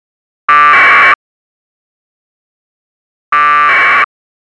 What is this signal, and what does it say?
Packet radio (AX.25, as in APRS), 1200 baud, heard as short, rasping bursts.